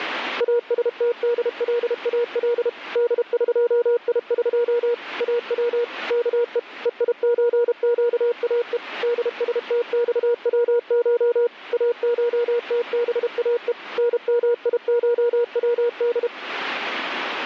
Morse code (Persian alphabet), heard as a keyed tone, machine-sent, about 32 wpm, 480 Hz. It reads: استدلال دقیق او که هیچگاه دستخوش اشتباه نمیشود